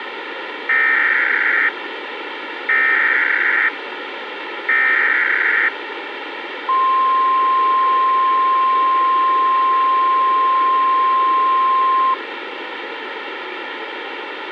Emergency Alert System (SAME) tones (header bursts, then the 1050 Hz attention tone), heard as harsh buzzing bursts, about 520.83 baud, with radio hiss and a squelch burst at the end.